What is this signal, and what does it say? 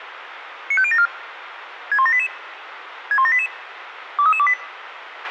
Five-tone selective call (ZVEI), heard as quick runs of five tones, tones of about 70 ms, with radio hiss and a squelch burst at the end. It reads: 95074 61788 61788 23328